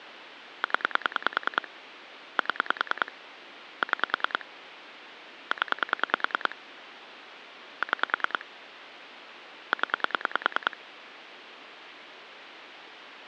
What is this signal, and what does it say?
Pulse dialling, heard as clicks on a phone line, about 10 pulses a second, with phone line noise. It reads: 0 7 6 0 6 0